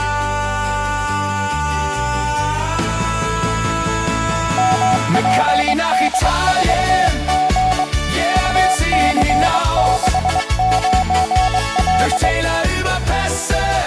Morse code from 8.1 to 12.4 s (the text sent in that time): UC69L